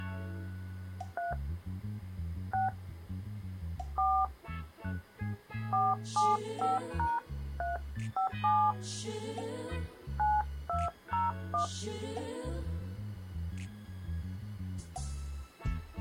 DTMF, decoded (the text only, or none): 3 6 4 475#357 9201